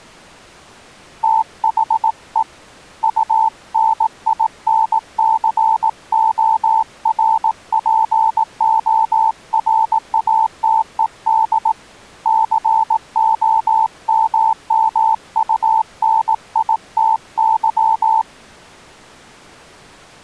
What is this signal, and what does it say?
Morse code, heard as a keyed tone, hand-sent with a paddle, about 18 wpm, 890 Hz. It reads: THE UNINCORPORATED COMMUNITY